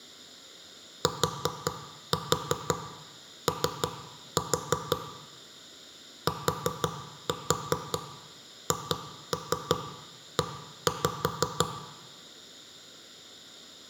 Tap code, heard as knocks on wood, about 5 knocks a second, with room echo. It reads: TO THE